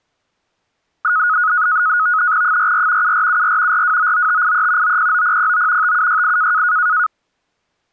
NAVTEX (SITOR-B), 100 baud, 170 Hz shift, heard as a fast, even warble, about 1360 Hz centre. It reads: 44 7474 4299583 909009 5768